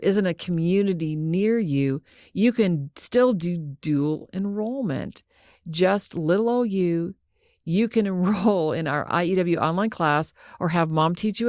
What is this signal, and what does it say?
Speech in English. There is no code.